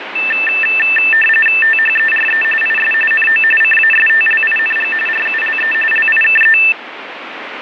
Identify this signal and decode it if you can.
RTTY (45.45 baud, 850 Hz shift), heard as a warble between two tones, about 2200 Hz centre, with radio static. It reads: THERE IS NO CASTLING RULE LIKE